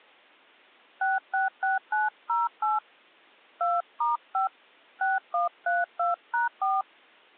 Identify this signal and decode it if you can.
DTMF, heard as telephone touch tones, dialled by hand, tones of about 160 ms. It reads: 666908 2*5 6132#4